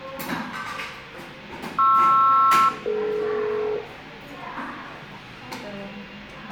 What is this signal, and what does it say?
Aircraft SELCAL, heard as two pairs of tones, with the noise of a crowd indoors. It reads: PR-DE